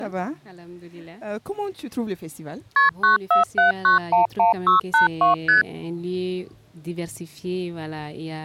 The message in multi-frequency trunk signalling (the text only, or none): KP 947911682 ST